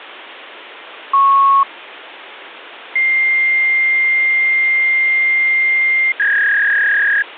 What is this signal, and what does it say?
Fax machine handshake, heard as a beep, a long tone and a warble, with phone line noise.